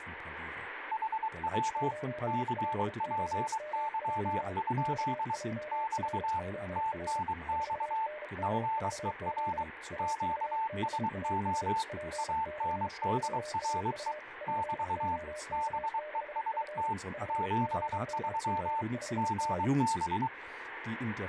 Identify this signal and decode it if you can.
Morse code, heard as two keyed tones, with radio static. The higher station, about 23 wpm, 890 Hz: HW CPY? <BT> TNX FER QSO ANDRE <BT> BEST 73 GB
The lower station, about 33 wpm, 610 Hz: 9LOMJ XJRZR 4NRVZ AVBAS PC3AU POK6F 50G5D